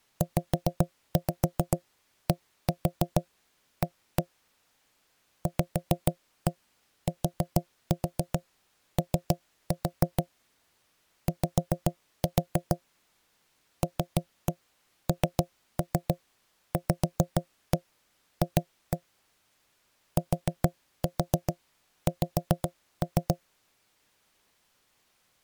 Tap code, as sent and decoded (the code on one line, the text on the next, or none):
5-5 1-4 1-1 / 5-1 4-4 3-4 / 5-4 / 3-1 3-3 5-1 2-1 / 4-4 5-3
ZDA VTO Y LNVF TX